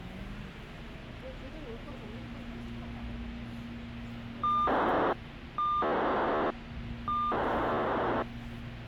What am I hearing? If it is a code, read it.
POCSAG pager data (2400 baud), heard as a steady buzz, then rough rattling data, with radio hiss and the noise inside a subway train.